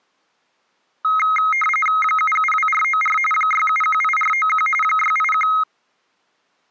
RTTY (45.45 baud, 850 Hz shift), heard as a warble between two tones, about 1700 Hz centre. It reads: 772494 6718491 681